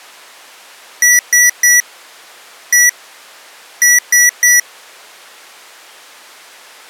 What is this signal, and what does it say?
Beep code, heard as beeps from a small speaker, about 1950 Hz. 3-1-3. In Phoenix BIOS tables: interrupt mask register failure.